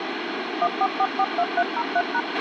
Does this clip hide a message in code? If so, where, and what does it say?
Yes: DTMF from 0.6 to 2.2 s, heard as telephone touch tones, dialled by machine, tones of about 50 ms, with radio hiss and a squelch burst at the end. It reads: 14442303#